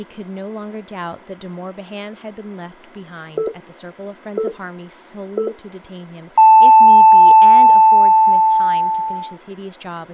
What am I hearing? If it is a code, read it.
Radio time signal (three low pips and a long one an octave up, as on NHK), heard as pips, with speech in English.